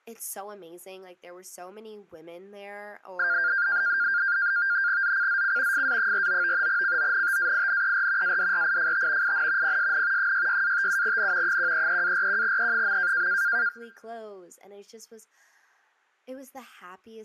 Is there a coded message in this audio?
Yes: NAVTEX (SITOR-B), 100 baud, 170 Hz shift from 3.2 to 13.7 s, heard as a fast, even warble, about 1500 Hz centre, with speech in English. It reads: ZCZC FA49 CONTAINER ADRIFT IN PSN 66-57N 133-41E.